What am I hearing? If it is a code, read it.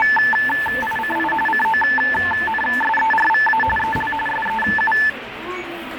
RTTY (45.45 baud, 850 Hz shift), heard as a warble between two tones, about 1310 Hz centre, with radio static and the noise of a crowd indoors. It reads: … CONSERVA EL SEU